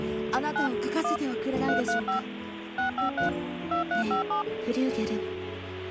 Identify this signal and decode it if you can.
DTMF, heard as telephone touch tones, dialled by machine, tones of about 120 ms, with phone line noise. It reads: 9 1 335 653 2357